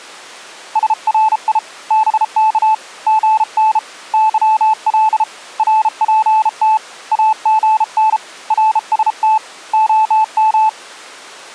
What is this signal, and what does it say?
Morse code, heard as a keyed tone, hand-sent with a bug key, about 33 wpm, 870 Hz. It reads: SRI BK GN YL RPT AGN RST OM